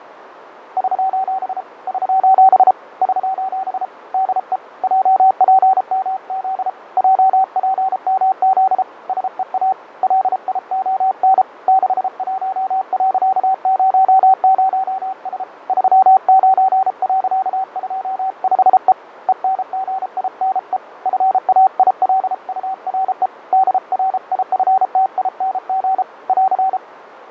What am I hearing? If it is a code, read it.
Morse code, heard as a keyed tone, hand-sent with a paddle, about 33 wpm, 760 Hz, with radio static, fading and a narrow filter. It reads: <SOS> <SOS> <SOS> DE JPMZ JPMZ SEA LION 61.00S 39.25E ENGINE FAILURE DRIFTING <AR>